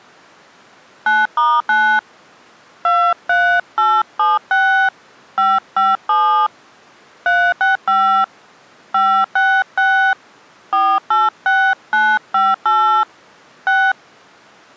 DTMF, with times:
1.1-2.0 9*9
2.8-4.9 23876
5.4-6.5 557
7.3-8.2 365
8.9-10.1 566
10.7-13.0 486958
13.7-13.9 6

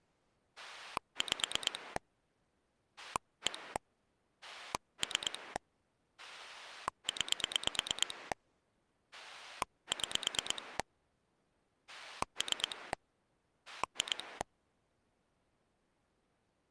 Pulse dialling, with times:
0.6-2.0 5
3.0-3.8 1
4.4-5.6 3
6.2-8.3 9
9.1-10.8 6
11.9-12.9 3
13.7-14.4 2

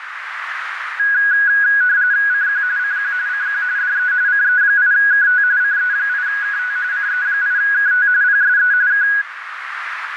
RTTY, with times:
2.3-2.6 CQ
2.8-3.1 CQ
3.3-3.6 CQ
3.8-4.1 DE
4.3-5.4 CE8KT
5.6-6.8 CE8KT
6.9-8.1 CE8KT
8.2-8.7 PSE
8.9-9.1 K

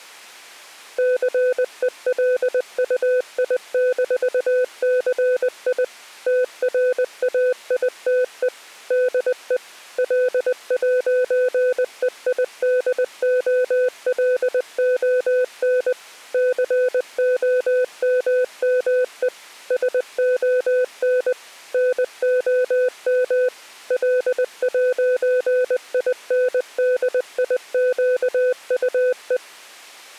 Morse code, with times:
1.0-5.8 CELUI-CI
6.3-8.5 TRAITE
8.9-9.6 DE
10.0-15.9 L'EIDOLON
16.3-19.3 COMME
19.7-21.3 SON
21.7-23.5 NOM
23.9-29.4 L'INDIQUE

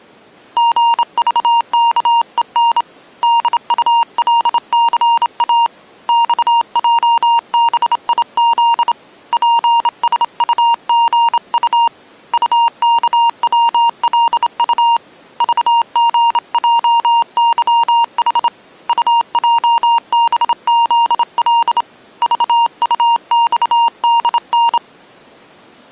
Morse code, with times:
0.6-2.8 GVKEN
3.2-5.7 DULCA
6.1-8.9 XJBIZ
9.3-11.9 PSUGU
12.3-15.0 UKWLU
15.4-18.5 VGJYH
18.9-21.8 UJBZL
22.2-24.8 VUXDN

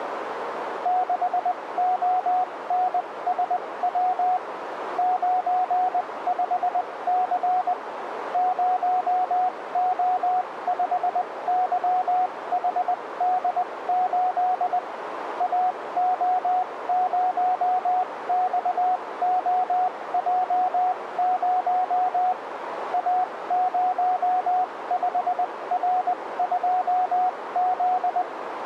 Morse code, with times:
0.9-4.4 6ONSW
5.0-7.7 95C
8.3-14.8 0O5YHD8
15.4-22.3 AO0XOJ0
22.9-28.2 A05R2Z

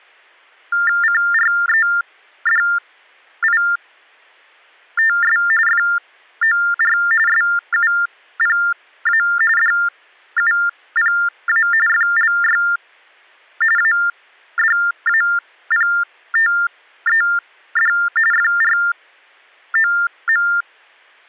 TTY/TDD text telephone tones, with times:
1.0-5.4 CREDITS
5.7-7.0 FOR
7.3-9.2 SUPA
9.6-11.7 DUPA
11.9-12.6 FLY
13.8-17.9 ADAPTED
18.3-20.5 FROM

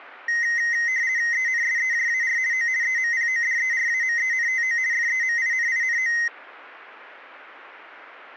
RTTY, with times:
1.3-2.4 ENSEJAR
2.5-2.7 O
2.8-4.8 EMPODERAMENTO
4.9-6.1 FEMININO

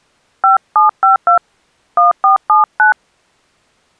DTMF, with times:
0.4-1.4 5752
2.0-2.9 1479

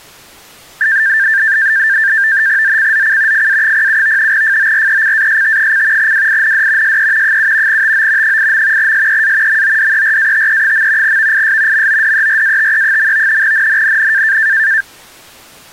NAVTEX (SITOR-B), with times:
2.6-3.5 ZCZC
3.3-4.3 FA07
4.3-6.1 FORECAST:
6.0-7.0 WIND
6.8-7.4 SE
7.2-7.8 7
7.7-8.4 TO
8.2-8.9 8.
8.8-9.6 SEA
9.5-11.2 MODERATE.
11.0-11.9 VIS
11.7-13.4 MODERATE.
13.4-14.4 NNNN

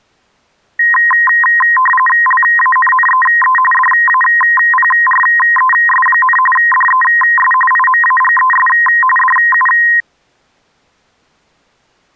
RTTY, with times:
2.3-3.6 LANNEE
3.7-6.4 DAPRES,
6.6-7.5 DES
7.7-8.7 IMAGES
9.2-9.7 DU

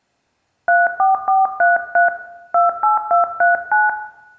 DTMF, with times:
0.7-2.1 34433
2.5-3.9 28239

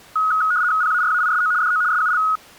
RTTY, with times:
0.8-1.5 PARAISO
1.6-1.8 DO
1.9-2.2 SUL

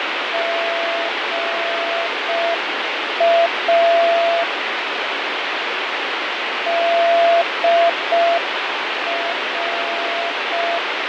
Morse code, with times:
0.3-4.4 GA
6.7-10.8 DR

